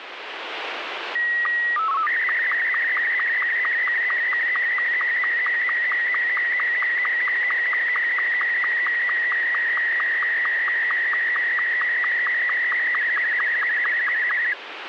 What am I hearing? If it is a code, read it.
SSTV (slow-scan television), Martin M2, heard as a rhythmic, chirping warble, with radio static.